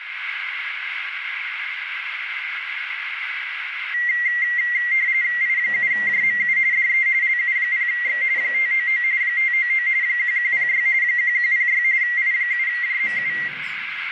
RTTY (45.45 baud, 170 Hz shift), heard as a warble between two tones, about 2000 Hz centre, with radio static and a narrow filter. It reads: I7JMU DE LU0X 599 599 1106 1106 I7JMU